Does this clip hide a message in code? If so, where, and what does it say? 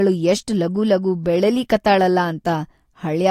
No, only speech in Kannada.